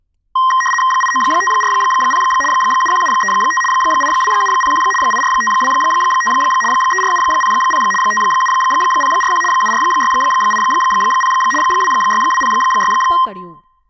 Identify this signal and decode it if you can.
RTTY (75 baud, 850 Hz shift), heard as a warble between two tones, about 1470 Hz centre, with speech in Gujarati. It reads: 89540 71735 82701 84525 34700 57041 74680 26206